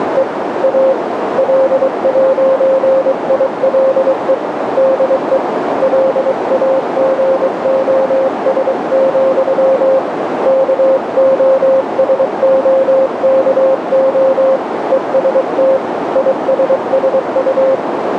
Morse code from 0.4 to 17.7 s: A L'ILE DE LAGOS, KOSOKO EST ISSU

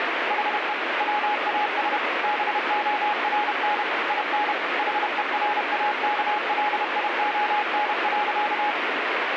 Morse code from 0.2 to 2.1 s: HE WAS

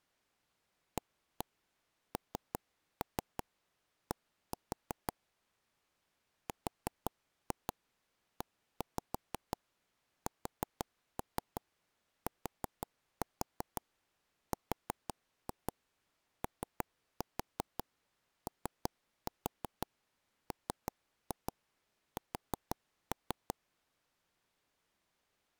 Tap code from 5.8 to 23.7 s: RESTROOMS

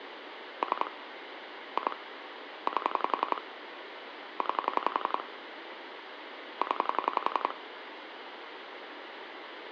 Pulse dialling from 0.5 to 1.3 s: 3

